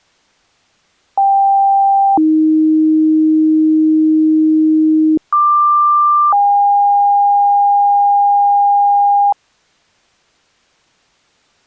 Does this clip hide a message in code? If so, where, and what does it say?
Yes: two-tone page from 1.2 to 9.3 s, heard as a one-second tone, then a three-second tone, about 790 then 310 Hz, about 1180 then 810 Hz.